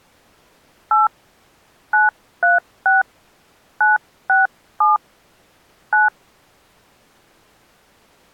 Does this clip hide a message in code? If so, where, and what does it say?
Yes: DTMF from 0.9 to 6.1 s, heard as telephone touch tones, dialled by hand, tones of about 160 ms. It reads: 8 936 967 9